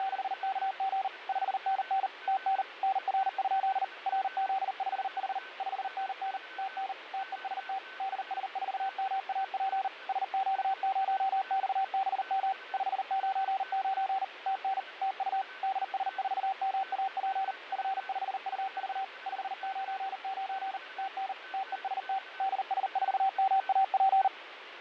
Morse code, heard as a keyed tone, machine-sent, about 39 wpm, 770 Hz, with radio static, fading and a weaker station near 1520 Hz. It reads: … 5NN TN NR? RZ5H 5NN TN TEST DS4MAP SQ0XBM 599 TN TU DS4MAP F5UV 599 TN TEST DS4MAP